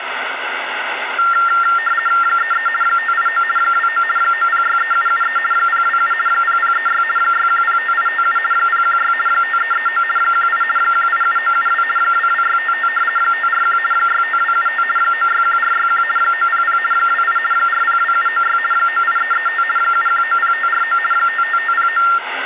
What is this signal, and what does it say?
RTTY (50 baud, 450 Hz shift), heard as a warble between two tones, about 1600 Hz centre, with radio static. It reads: 33 589 29 9063773 027 0036 6105857 016 5339 18 187972 22655 541 65275 961461 900 28 402796 98335 7190549 55509